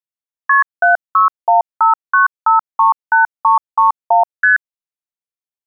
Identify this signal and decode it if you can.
Multi-frequency trunk signalling (R1, as on North American trunks), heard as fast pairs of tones, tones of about 130 ms. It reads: KP 76159538331 ST